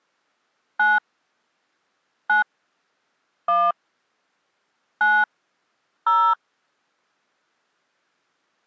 DTMF, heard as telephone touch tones, dialled by hand, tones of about 230 ms. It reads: 9 9 1 9 0